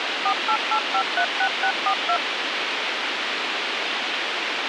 DTMF, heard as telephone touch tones, dialled by machine, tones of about 80 ms, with radio hiss. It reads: 488536642